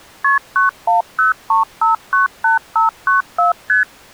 Multi-frequency trunk signalling (R1, as on North American trunks), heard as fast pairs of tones, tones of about 140 ms. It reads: KP 9103598594 ST